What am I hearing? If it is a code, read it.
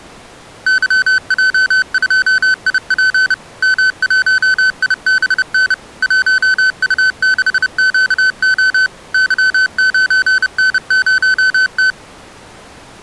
Morse code, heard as electronic beeps, machine-sent, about 30 wpm, 1500 Hz. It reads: YJ2IP M1IBN 1U6QO Y9N0T